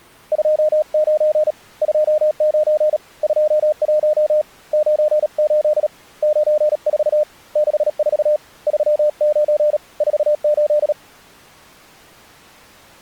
Morse code, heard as a keyed tone, hand-sent with a bug key, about 37 wpm, 610 Hz. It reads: 29 29 21 98 94 64 39 48